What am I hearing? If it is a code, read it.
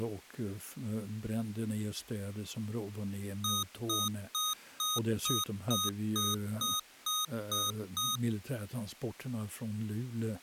Beep code, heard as beeps from a small speaker, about 1240 Hz, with speech in Swedish. 11 short. In AMI BIOS tables: cache memory error.